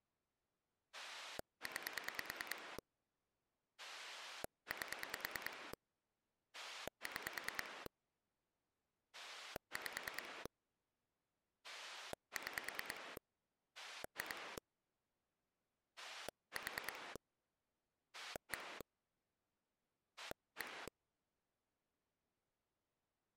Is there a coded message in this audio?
Yes: pulse dialling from 0.9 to 20.9 s, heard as a rotary dial, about 9 pulses a second. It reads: 9 8 6 5 6 2 4 1 1